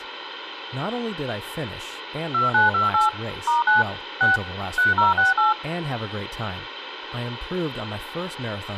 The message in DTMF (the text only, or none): 2928 *9 6 3068